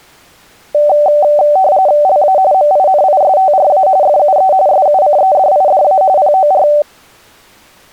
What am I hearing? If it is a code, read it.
RTTY (45.45 baud, 170 Hz shift), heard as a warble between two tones, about 680 Hz centre. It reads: LA MINISTRA FUE SUCEDIDA POR